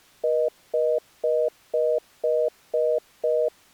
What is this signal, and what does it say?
Telephone call progress tone (North American plan), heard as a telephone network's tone, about 480, 620 Hz, 0.25 s on and 0.25 s off. Congestion tone.